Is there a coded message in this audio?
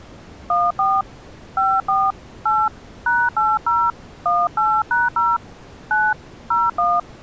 Yes: DTMF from 0.5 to 7.0 s, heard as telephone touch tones, dialled by hand, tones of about 210 ms. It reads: 14 54 8 #80 18#0 9 01